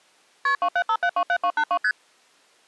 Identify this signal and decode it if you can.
Multi-frequency trunk signalling (R1, as on North American trunks), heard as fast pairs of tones, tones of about 70 ms. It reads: KP 275727282 ST